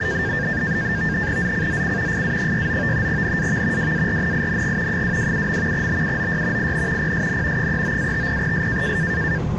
NAVTEX (SITOR-B), 100 baud, 170 Hz shift, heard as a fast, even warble, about 1700 Hz centre, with the noise inside a subway train. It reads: ZCZC FA69 NAV WARNING 227. BUOY IN PSN 39-50S